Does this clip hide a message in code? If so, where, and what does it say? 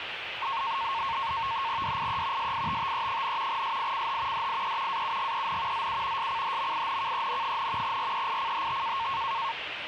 Yes: NAVTEX (SITOR-B), 100 baud, 170 Hz shift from 0.4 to 9.5 s, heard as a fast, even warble, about 1000 Hz centre, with radio static and the noise of a park. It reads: DIE SITTE, SICH DIE AUGEN ZU SCHMINKEN, REICHT